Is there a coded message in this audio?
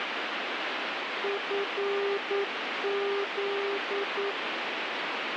Yes: Morse code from 1.2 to 4.4 s, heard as a keyed tone, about 9 wpm, 400 Hz, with radio static. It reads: FZ